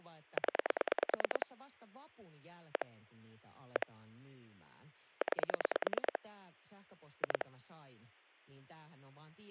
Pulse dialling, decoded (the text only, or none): 0 1 1 9 2